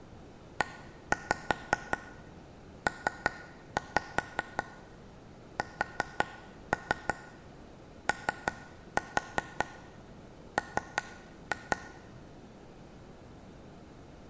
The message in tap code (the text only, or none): EPSOM